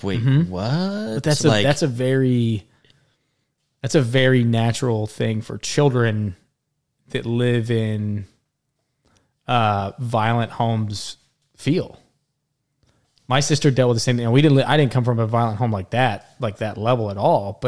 Speech in English. There is no code.